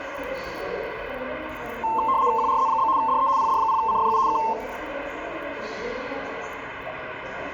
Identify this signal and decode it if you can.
RTTY (75 baud, 170 Hz shift), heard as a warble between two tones, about 980 Hz centre, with the noise of a subway station. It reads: QRZ? DE PD0CFU K